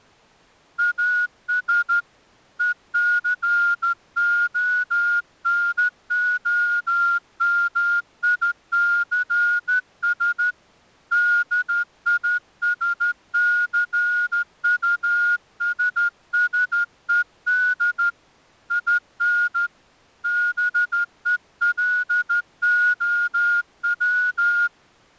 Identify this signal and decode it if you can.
Morse code, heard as a whistle, hand-sent with a straight key, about 13 wpm. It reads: AS ECONOMICS DISCUSSED IN BELOW